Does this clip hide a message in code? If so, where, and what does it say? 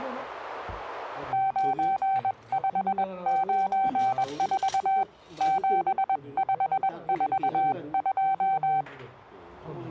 Yes: Morse code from 1.3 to 8.9 s, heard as a keyed tone, hand-sent with a paddle, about 21 wpm, 770 Hz, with the noise of a restaurant. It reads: 9594 7542